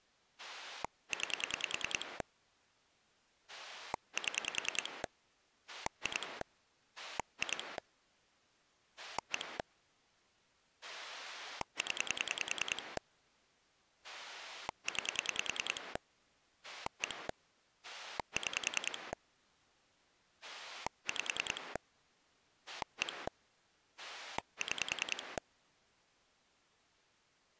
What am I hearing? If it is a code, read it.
Pulse dialling, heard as a rotary dial, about 10 pulses a second. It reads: 9 7 2 2 1 0 9 1 6 5 1 6